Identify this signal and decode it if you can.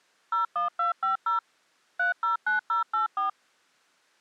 DTMF, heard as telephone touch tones, dialled by machine, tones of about 130 ms. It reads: 01250 309084